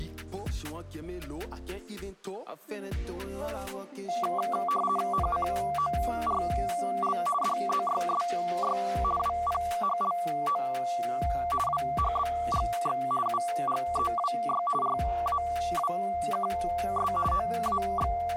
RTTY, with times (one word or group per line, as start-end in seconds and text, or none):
5.1-7.2 NCORL
7.4-8.8 DZYSY
9.2-10.6 WPHLO
11.7-13.0 WHBGX
13.3-14.6 UGEWY
14.8-17.1 RAWKS
17.3-18.4 …